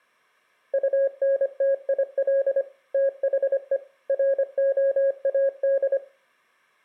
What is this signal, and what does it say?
Morse code, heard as a keyed tone, machine-sent, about 25 wpm, 550 Hz, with room echo. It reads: UNTIL THE ROAD